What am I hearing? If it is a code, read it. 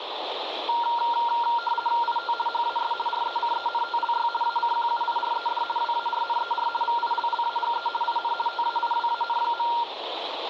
RTTY (50 baud, 450 Hz shift), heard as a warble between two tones, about 1170 Hz centre, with radio static. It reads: IT HAS RECENTLY ACQUIRED WARNER VILLAGE IN TAIWAN.